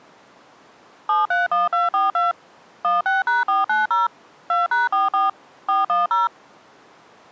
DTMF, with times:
1.1-2.3 731242
2.8-4.1 16#490
4.5-5.3 2#44
5.7-6.3 410

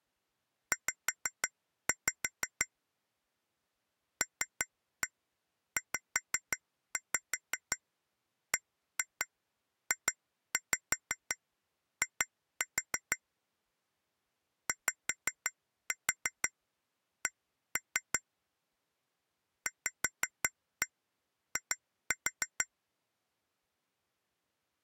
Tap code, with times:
0.7-2.7 Z
4.2-13.2 LZBJI
14.7-18.2 YC
19.7-22.7 VI

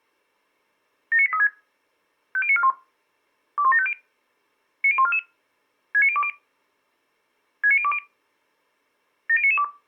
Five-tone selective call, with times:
1.1-1.5 79836
2.4-2.7 50941
3.6-3.9 21750
4.8-5.2 90144
5.9-6.3 69020
7.6-8.0 69020
9.3-9.6 70992

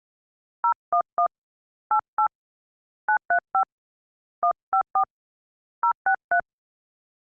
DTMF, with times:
0.6-1.3 011
1.9-2.3 88
3.1-3.6 935
4.4-5.0 154
5.8-6.4 063

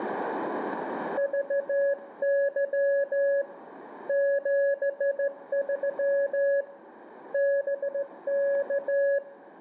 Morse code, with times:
1.2-3.4 VY
4.1-6.6 73
7.3-9.2 BK

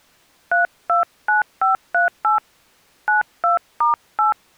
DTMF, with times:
0.5-2.4 329538
3.1-4.3 92*8

